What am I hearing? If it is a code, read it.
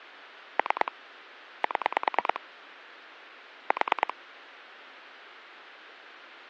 Pulse dialling, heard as clicks on a phone line, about 9 pulses a second. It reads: 3 7 4